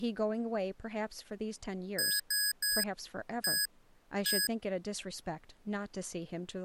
Beep code, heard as beeps from a small speaker, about 1650 Hz, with speech in English. 3-1-1. In Phoenix BIOS tables: DMA register failure.